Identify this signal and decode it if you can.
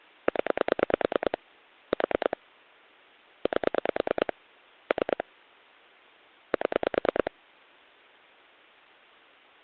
Pulse dialling, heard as clicks on a phone line, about 9 pulses a second. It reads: 0 4 8 3 7